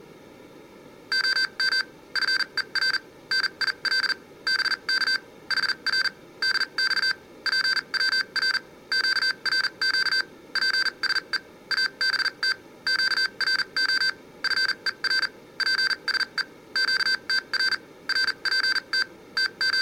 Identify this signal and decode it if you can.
Morse code, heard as electronic beeps, machine-sent, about 40 wpm, spaced as for 32 wpm, 1550 Hz, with room echo. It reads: OM FER NIL BK HR DX PWR QRQ PSE ABT QRO FER PSE QTR RPT …